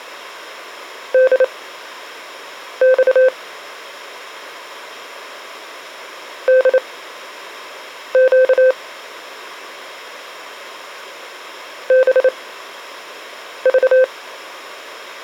Morse code, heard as a keyed tone, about 28 wpm, spaced as for 6 wpm, 520 Hz. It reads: DX DQ BV